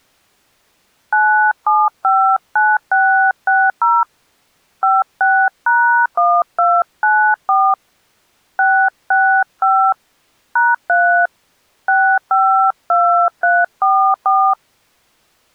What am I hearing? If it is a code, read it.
DTMF, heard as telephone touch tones, dialled by hand, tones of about 290 ms. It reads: 9759660 56#1294 665 #3 652344